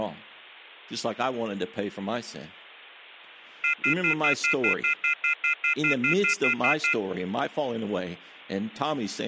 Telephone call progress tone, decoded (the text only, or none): off-hook warning tone